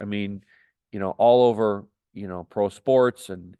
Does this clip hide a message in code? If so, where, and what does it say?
No, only speech in English.